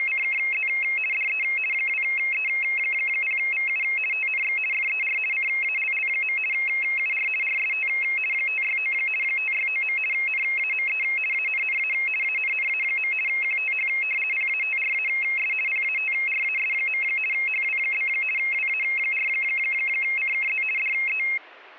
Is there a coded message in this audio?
Yes: RTTY (50 baud, 450 Hz shift) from 0.0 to 21.4 s, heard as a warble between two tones, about 2350 Hz centre. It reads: … DE 2E0VU TNX FER CALL. UR RST 569 569. NAME ANNA ANNA. QTH PATRAS PATRAS. HW? WA4CKZ DE